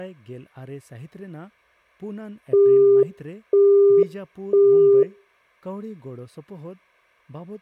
Telephone call progress tone (single-tone plan, as in Europe, Japan and elsewhere), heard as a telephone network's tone, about 400 Hz, 0.5 s on and 0.5 s off, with room echo and speech in Santali. Busy tone.